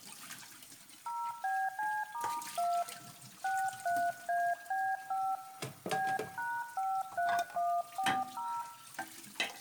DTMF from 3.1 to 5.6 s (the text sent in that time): 63AB5